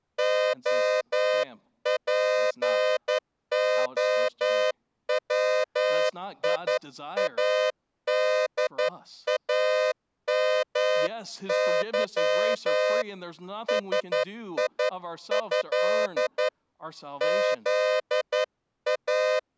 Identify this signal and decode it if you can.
Morse code (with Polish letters), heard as a horn, hand-sent with a straight key, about 11 wpm, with speech in English. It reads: OPOWIADAMY SIĘ ZA